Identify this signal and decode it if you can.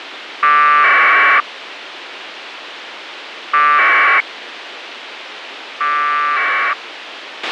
Packet radio (AX.25, as in APRS), 1200 baud, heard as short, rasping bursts, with radio hiss and a squelch burst at the end.